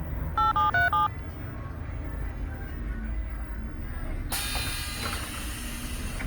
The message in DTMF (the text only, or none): 8737